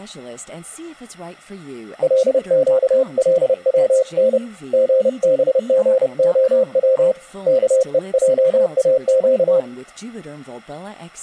Morse code (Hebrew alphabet), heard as a keyed tone, hand-sent with a paddle, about 30 wpm, 520 Hz, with speech in English. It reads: לקלצן גבגהץ כועאק